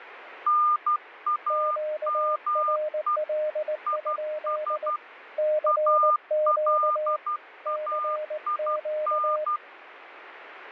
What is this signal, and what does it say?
Morse code, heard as two keyed tones, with radio static. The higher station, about 12 wpm, 1210 Hz: NAME IS ALAIN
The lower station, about 19 wpm, 610 Hz: QRL? CQ CQ